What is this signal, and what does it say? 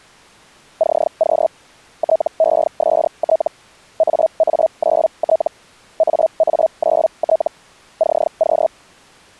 Hellschreiber (Feld-Hell, 122.5 baud), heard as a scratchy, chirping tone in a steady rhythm, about 640 Hz. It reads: CQ TEST AA9T AA9T CQ